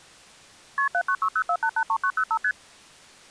Multi-frequency trunk signalling (R1, as on North American trunks), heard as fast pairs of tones, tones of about 70 ms. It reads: KP 79604883905 ST